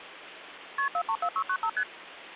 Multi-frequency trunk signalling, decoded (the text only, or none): KP 434695 ST